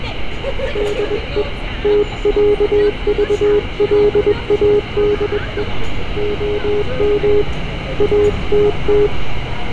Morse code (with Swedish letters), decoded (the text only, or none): DE TÄVLADE OM ATT